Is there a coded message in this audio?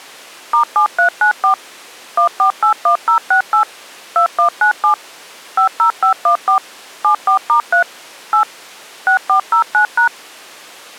Yes: DTMF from 0.5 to 10.1 s, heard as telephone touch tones, dialled by machine, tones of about 100 ms. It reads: *7394 1481068 2197 50514 74*3 8 6409#